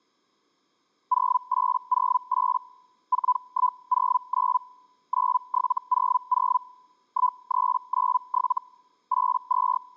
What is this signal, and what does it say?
Hellschreiber (Feld-Hell, 122.5 baud), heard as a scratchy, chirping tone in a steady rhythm, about 1000 Hz. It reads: 0808 4109 9700 1397 …